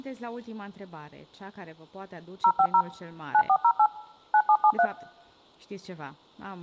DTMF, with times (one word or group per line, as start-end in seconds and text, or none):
2.4-2.8 050
3.3-3.9 9408
4.3-4.9 9773